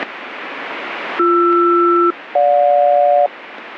Aircraft SELCAL, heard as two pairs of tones, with radio static. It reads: BR-GJ